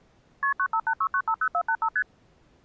Multi-frequency trunk signalling (R1, as on North American trunks), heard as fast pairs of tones, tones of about 70 ms. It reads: KP 9586950485 ST